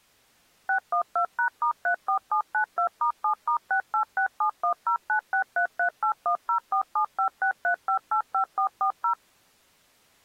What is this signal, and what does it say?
DTMF, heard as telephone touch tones, dialled by machine, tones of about 100 ms. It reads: 612#*34792*7*686710963381047563585440